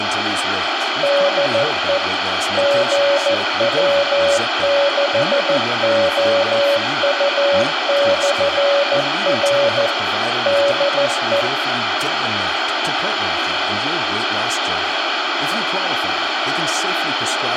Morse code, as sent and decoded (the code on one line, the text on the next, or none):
-.. . / --. .-- -.... --- ..- -..-. .-. / -.. .
DE GW6OU/R DE